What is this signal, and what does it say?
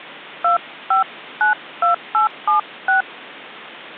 DTMF, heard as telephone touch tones, dialled by hand, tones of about 120 ms. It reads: 2592876